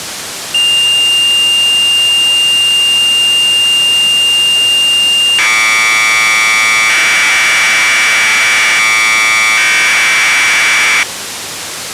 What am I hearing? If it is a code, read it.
Commodore tape loading (standard loader), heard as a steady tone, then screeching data, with tape hiss.